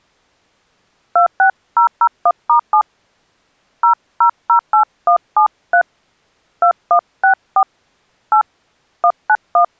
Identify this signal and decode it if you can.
DTMF, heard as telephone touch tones, dialled by hand, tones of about 80 ms. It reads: 26001*7 0008173 2164 8 191